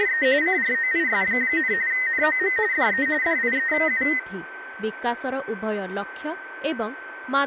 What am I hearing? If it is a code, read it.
RTTY (45.45 baud, 170 Hz shift), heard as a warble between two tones, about 1950 Hz centre, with radio static, a steady whistle near 1540 Hz, room echo and speech in Odia. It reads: … CROIS, NOM DE DIEU